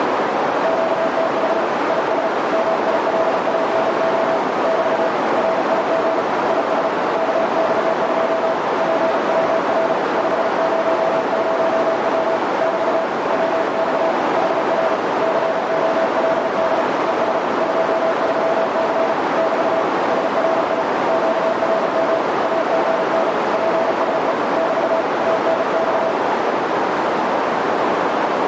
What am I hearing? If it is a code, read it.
Morse code, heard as a keyed tone, hand-sent with a paddle, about 35 wpm, 660 Hz, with heavy radio static and a narrow filter. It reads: QTH IS MILANO <BT> RIG IS KX2 PWR 500W <BT> WX HR COLD ES 23C <BT> SRI QRM AGN PSE <BT> TNX